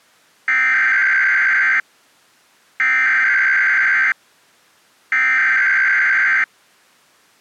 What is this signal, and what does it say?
Emergency Alert System (SAME) tones (header bursts), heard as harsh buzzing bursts, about 520.83 baud.